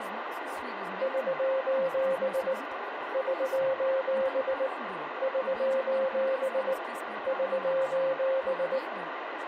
Morse code, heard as a keyed tone, hand-sent with a paddle, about 19 wpm, 530 Hz, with radio static, room echo and speech in Portuguese. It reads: <SOS> <SOS> <SOS> <SOS>